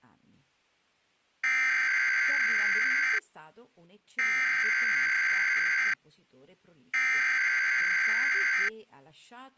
Emergency Alert System (SAME) tones (header bursts), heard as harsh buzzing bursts, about 520.83 baud, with speech in Italian.